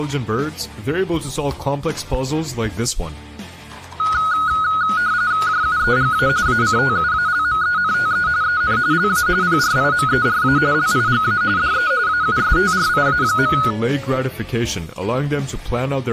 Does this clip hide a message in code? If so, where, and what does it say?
Yes: RTTY (45.45 baud, 170 Hz shift) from 4.0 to 13.7 s, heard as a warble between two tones, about 1360 Hz centre. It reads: JUEGA ACTUALMENTE EN LA PRIMERA LIGA DE AUSTRIA.